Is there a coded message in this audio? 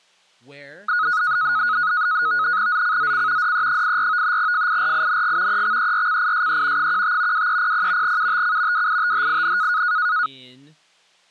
Yes: NAVTEX (SITOR-B), 100 baud, 170 Hz shift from 0.9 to 10.3 s, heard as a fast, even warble, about 1360 Hz centre, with speech in English. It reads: ZCZC DE84 FIRING EXERCISE 15 2300 UTC WITHIN